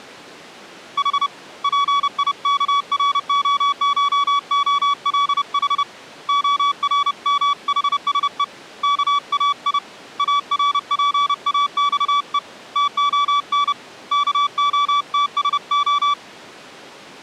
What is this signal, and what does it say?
Morse code (Greek alphabet), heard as a keyed tone, hand-sent with a paddle, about 30 wpm, 1140 Hz. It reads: Η ΠΙΚΡΟΧΟΛΗ ΟΡΜΗΣΕ ΚΑΙ ΑΡΠΑΞΕ ΤΟΝ ΚΟΤΣΟ